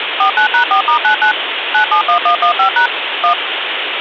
DTMF, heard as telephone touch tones, dialled by machine, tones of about 100 ms, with phone line noise. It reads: 49#4*99 971115# 1